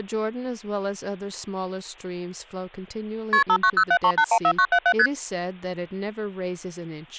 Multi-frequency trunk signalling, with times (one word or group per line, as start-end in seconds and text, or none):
3.3-3.4 KP
3.5-4.9 59073814977
5.0-5.1 ST